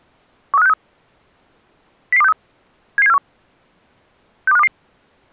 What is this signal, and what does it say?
Five-tone selective call (EEA), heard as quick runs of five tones, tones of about 40 ms. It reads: 13563 00263 77741 62522